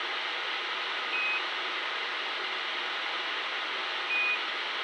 Quindar tones, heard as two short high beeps, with radio hiss.